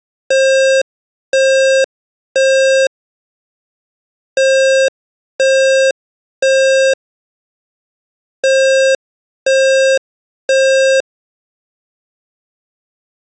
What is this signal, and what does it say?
Alarm pattern, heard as an alarm's beeps, played three times, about 530 Hz. Temporal three. Smoke or fire, evacuate.